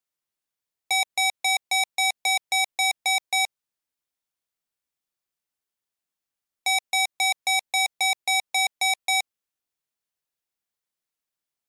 Beep code, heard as beeps from a small speaker, played twice, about 760 Hz. 10 short. In AMI BIOS tables: CMOS shutdown register error.